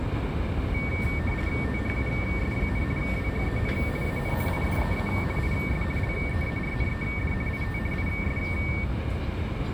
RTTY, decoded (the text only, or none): THUS, WHEN AN IDEA IS LEARNED IT IS